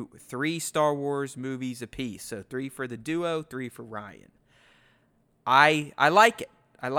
Speech in English. There is no code.